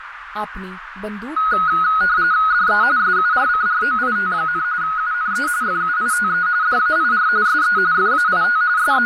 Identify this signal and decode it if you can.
RTTY (45.45 baud, 170 Hz shift), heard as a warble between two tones, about 1360 Hz centre, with radio static, a narrow filter and speech in Punjabi. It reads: DE SURCROIT, UNE FUITE DAIR SE FAIT …